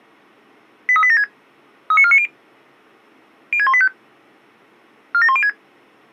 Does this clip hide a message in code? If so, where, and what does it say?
Yes: five-tone selective call (ZVEI) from 0.9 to 5.5 s, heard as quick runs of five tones, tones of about 70 ms. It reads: 83876 39490 06185 47106